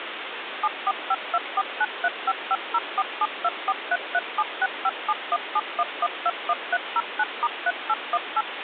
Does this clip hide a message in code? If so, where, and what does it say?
Yes: DTMF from 0.6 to 8.4 s, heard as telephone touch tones, dialled by machine, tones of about 50 ms, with phone line noise. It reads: 74524935504724337657171121309*3818